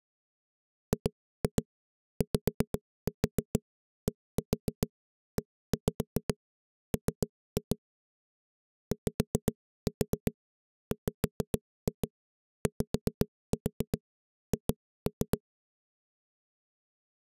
Tap code, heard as knocks on a wall, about 7 knocks a second. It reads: GYDEM YWYH